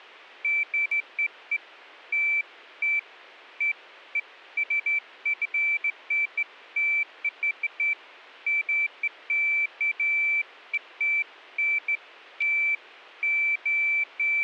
Beeps of irregular length. There is no code.